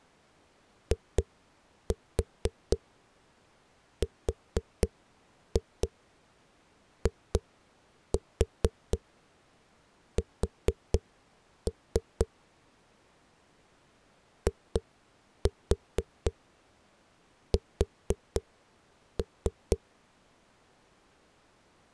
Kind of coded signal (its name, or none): tap code